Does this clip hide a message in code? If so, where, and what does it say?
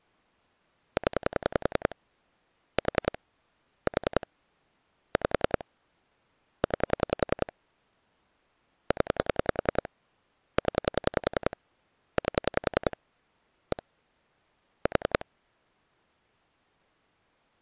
Yes: pulse dialling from 1.0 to 15.2 s, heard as clicks on a phone line, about 10 pulses a second. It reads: 0 4 4 5 9 0 0 8 1 4